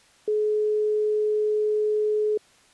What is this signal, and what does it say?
Telephone call progress tone (425 Hz plan, as in most of Europe), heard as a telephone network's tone, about 420 Hz. Dial tone.